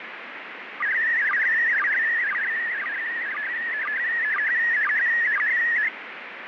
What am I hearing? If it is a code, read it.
SSTV (slow-scan television), PD 120, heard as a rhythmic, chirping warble, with radio static.